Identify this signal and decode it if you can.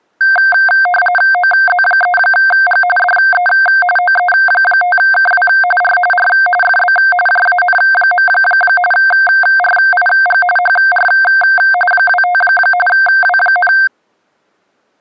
RTTY (45.45 baud, 850 Hz shift), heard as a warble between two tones, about 1140 Hz centre. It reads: OZ3G DE OE5KW R R FB JAN. RIG HR 25 W,